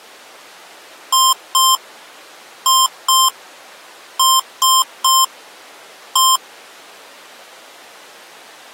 Beep code, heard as beeps from a small speaker, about 1050 Hz. 2-2-3-1. In Phoenix BIOS tables: unexpected interrupt.